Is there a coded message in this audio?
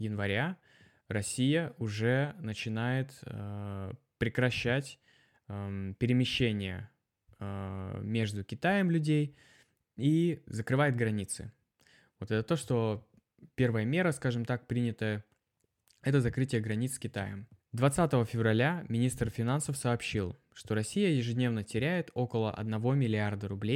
No, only speech in Russian.